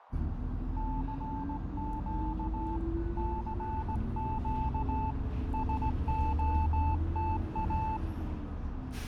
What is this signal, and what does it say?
Morse code, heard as a keyed tone, hand-sent with a straight key, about 17 wpm, 880 Hz, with radio static, fading, a narrow filter and the noise inside a bus. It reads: CQ CQ SOTA